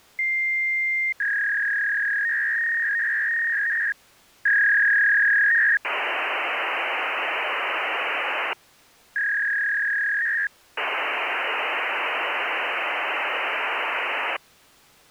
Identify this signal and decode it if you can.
Fax machine handshake, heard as a long tone, a warble and hiss.